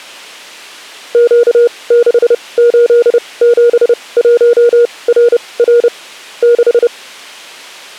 Morse code, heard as a keyed tone, machine-sent, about 30 wpm, spaced as for 22 wpm, 480 Hz. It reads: Q6871RR 6